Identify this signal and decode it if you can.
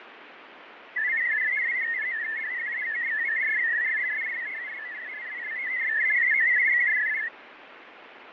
Multi-tone FSK (Olivia or MFSK type), about 500 Hz wide, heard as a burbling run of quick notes, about 62.5 baud, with radio static and fading.